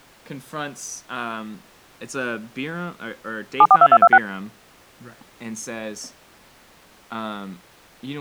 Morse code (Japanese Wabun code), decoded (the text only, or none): none